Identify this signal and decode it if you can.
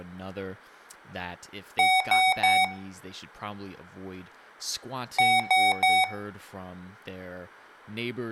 Beep code, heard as beeps from a small speaker, played twice, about 750 Hz, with room echo and speech in English. 3 short. In AMI BIOS tables: failure in the first 64 KB of memory; in Dell tables: chipset error.